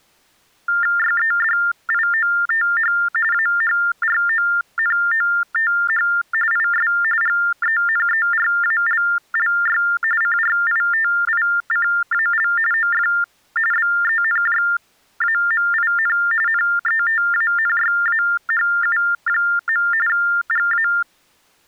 TTY/TDD text telephone tones (45.45 baud Baudot), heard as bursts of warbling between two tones, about 400 Hz shift, 1600 Hz centre. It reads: YEDIOTH AHRONOTH IS GENERALLY CRITICAL OF BENJAMIN NETANYAHU. GA